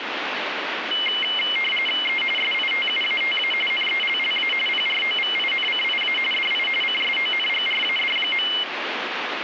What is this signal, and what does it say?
RTTY (45.45 baud, 850 Hz shift), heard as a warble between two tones, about 2550 Hz centre, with radio static. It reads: E SITUATA NELLA PROVINCIA DI CSONGRAD.